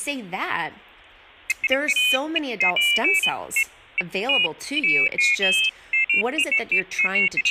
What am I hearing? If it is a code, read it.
Pairs of high tones at irregular times, with speech in English. There is no code.